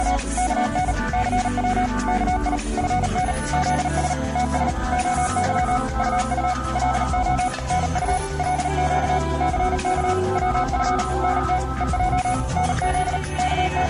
Morse code, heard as a keyed tone, machine-sent, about 38 wpm, 740 Hz. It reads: … KN CW KI FN ZS TS OY UU LO NU LQ CK WF NT EJ NZ …